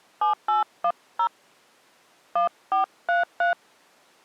DTMF, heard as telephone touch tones, dialled by hand, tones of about 110 ms. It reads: 7810 1433